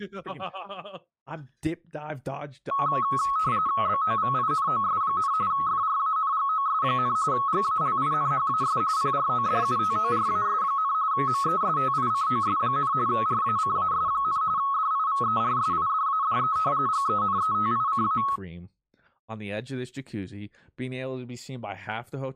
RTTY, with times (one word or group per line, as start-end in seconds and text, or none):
3.9-5.3 BOVINOS,
5.5-7.2 FRANGOS,
7.3-8.8 GALINHAS
9.0-10.9 PRODUTORAS,
11.1-12.9 MESTICOS,
13.1-14.4 RACAS,
14.6-16.6 DIVERSIDADE
16.9-18.2 GENETICA